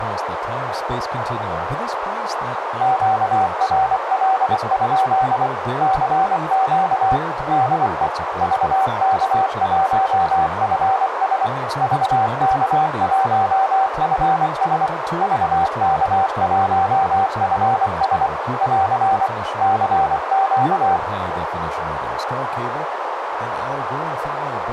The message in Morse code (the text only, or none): QRL? CQ DE VK1FS VK1FS VK1FS <AR> CQ